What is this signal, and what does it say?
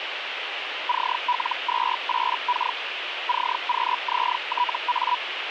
Hellschreiber (Feld-Hell, 122.5 baud), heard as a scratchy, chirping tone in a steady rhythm, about 980 Hz, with radio static. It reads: CL28K CQZTA